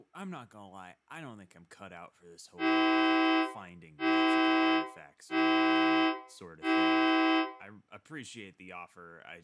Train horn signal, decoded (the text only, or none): 4 short